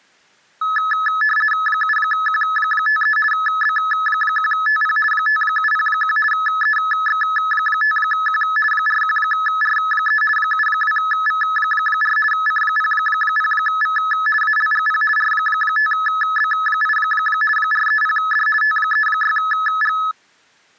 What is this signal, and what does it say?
RTTY (50 baud, 450 Hz shift), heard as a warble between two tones, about 1500 Hz centre. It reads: 7Q53 B1TP 5701 EX5Q 41R3 72V4 C00V ALGP R5B8 430D T36G